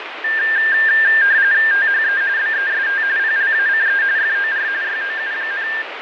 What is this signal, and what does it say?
RTTY (45.45 baud, 170 Hz shift), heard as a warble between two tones, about 1700 Hz centre, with radio static and fading. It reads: THE BEST PLACE FOR YOU,